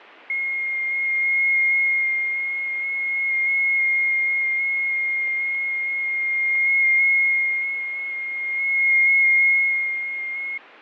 FT8 (one signal), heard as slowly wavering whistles, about 6.25 baud, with fading.